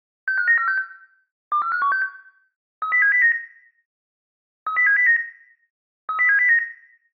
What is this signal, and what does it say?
Five-tone selective call (CCIR), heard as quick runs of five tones, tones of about 100 ms, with room echo. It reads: 65946 24516 30709 30709 30709